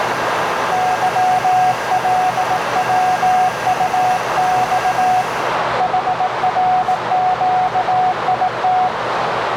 Morse code, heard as a keyed tone, hand-sent with a bug key, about 18 wpm, 740 Hz, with heavy radio static, a narrow filter and the noise of a cafe. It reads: YLWUX HRQIT